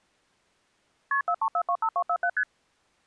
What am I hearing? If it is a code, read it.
Multi-frequency trunk signalling (R1, as on North American trunks), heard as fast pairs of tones, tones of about 70 ms. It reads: KP 43425247 ST